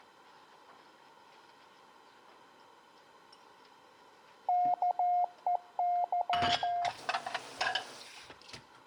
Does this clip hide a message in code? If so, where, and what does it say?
Yes: Morse code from 4.4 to 6.9 s, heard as a keyed tone, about 14 wpm, 710 Hz, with room echo and kitchen noise. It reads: KEY